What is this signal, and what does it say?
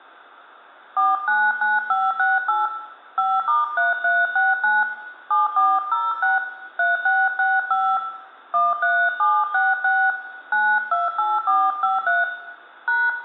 DTMF, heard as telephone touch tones, dialled by hand, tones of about 210 ms, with room echo. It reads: 499568 5*3369 7406 3665 13766 928453 #